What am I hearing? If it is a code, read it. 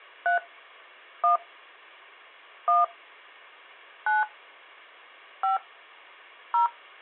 DTMF, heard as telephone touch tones, dialled by hand, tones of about 160 ms. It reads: 3 1 1 9 5 0